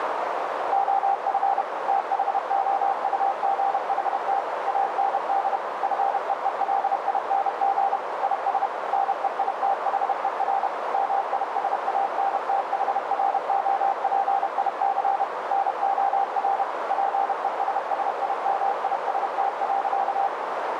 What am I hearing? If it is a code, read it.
Morse code, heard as a keyed tone, machine-sent, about 31 wpm, 790 Hz, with heavy radio static and a narrow filter. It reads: OF THOUGHT AND FEELING IS NEITHER MISANTHROPIC NOR PESSIMIST.